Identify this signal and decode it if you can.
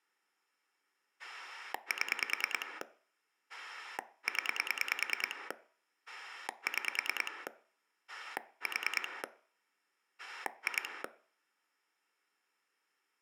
Pulse dialling, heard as a rotary dial, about 9 pulses a second. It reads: 7 0 6 4 2